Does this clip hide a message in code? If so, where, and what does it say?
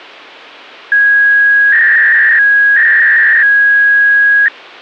Yes: 300-baud modem data (V.21 tones) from 0.9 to 4.5 s, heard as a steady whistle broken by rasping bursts, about 300 baud, 200 Hz shift.